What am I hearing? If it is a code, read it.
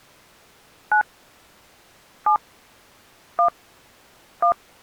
DTMF, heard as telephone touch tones, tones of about 100 ms. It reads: 9 7 1 1